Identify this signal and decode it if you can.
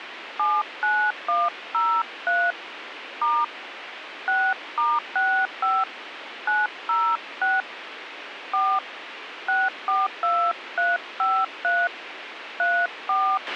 DTMF, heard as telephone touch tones, dialled by hand, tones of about 240 ms, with radio hiss and a squelch burst at the end. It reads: 79103 * 6*65 906 4 642353 34